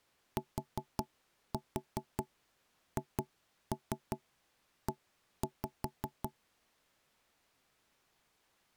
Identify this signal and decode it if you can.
Tap code, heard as knocks on wood, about 5 knocks a second. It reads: THE